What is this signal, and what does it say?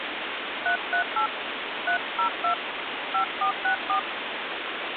DTMF, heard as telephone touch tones, dialled by hand, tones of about 100 ms, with phone line noise. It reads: 338 302 5464